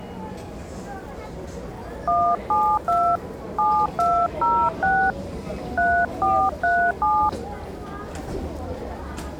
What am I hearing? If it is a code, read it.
DTMF, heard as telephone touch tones, dialled by hand, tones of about 280 ms, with the noise of a crowd indoors. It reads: 172 7206 3437